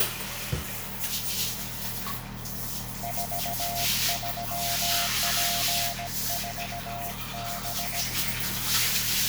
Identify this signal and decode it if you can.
Morse code, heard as a keyed tone, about 17 wpm, 700 Hz, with radio static, a narrow filter and the noise of a restroom. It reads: 43P4B